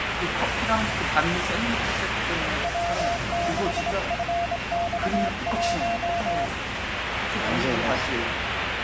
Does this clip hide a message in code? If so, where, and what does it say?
Yes: Morse code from 2.6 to 6.5 s, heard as a keyed tone, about 25 wpm, 690 Hz, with radio static and the noise of a restaurant. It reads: W6FX1